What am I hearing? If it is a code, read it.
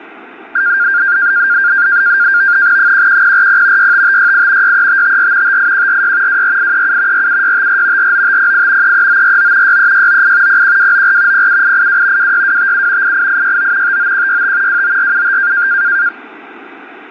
NAVTEX (SITOR-B), 100 baud, 170 Hz shift, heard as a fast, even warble, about 1500 Hz centre. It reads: 11040 65568 63554 58146 24837 47654 49508 33949 63698 01294 07882 26257 88869 59165 29475